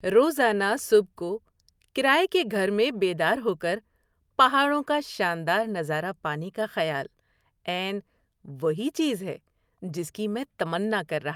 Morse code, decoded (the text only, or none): none